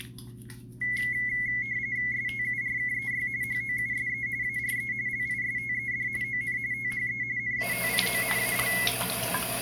RTTY (45.45 baud, 170 Hz shift), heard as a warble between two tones, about 2050 Hz centre, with the noise of a restroom. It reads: STURKEY HOUSE ARE LISTED ON THE NATIONAL